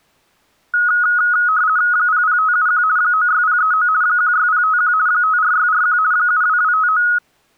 RTTY (50 baud, 170 Hz shift), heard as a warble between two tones, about 1360 Hz centre. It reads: 00571 96039 16051 54641 72259